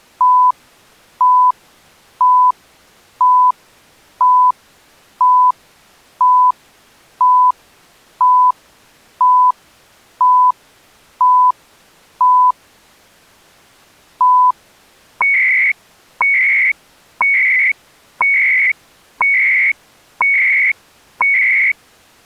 Radio time signal (CHU, Canada), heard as beeps and data bursts, one a second.